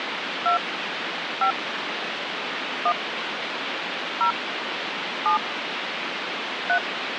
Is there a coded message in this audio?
Yes: DTMF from 0.5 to 6.8 s, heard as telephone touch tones, dialled by hand, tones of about 90 ms, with phone line noise. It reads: 2 5 1 0 7 3